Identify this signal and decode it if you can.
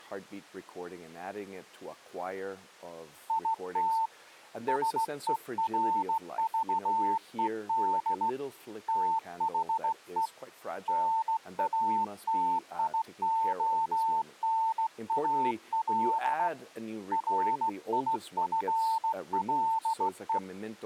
Morse code, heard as a keyed tone, hand-sent with a straight key, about 16 wpm, 900 Hz. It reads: IT SERVED THE NATIONAL RIFLE